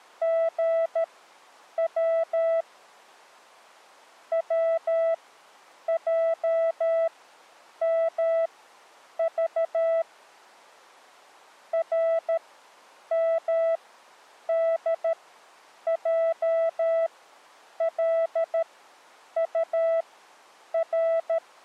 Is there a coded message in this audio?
Yes: Morse code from 0.2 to 21.4 s, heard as a keyed tone, machine-sent, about 13 wpm, spaced as for 8 wpm, 660 Hz. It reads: GW WJMV RMDJLUR